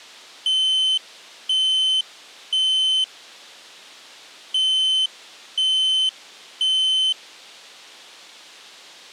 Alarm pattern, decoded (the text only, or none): temporal three